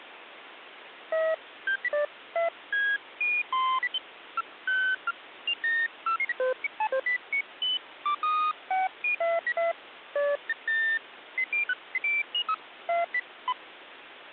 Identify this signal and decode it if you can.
Electronic bleeps of random pitch and length, with phone line noise. There is no code.